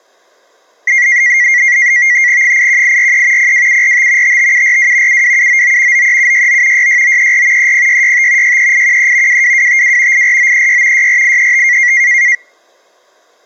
NAVTEX (SITOR-B), 100 baud, 170 Hz shift, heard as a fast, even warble, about 2050 Hz centre. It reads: 81843 02745 55742 72799 93769 66934 30665 63813 22252 84936 64835